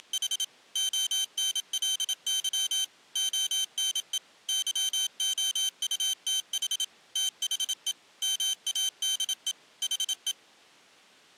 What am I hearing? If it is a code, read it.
Morse code, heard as a high beeper, machine-sent, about 27 wpm, 3100 Hz. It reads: … ONLY ONE YOUTH THE MADE HE